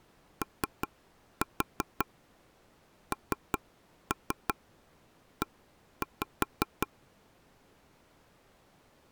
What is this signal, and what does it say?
Tap code, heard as taps on a table, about 5 knocks a second. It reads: ONE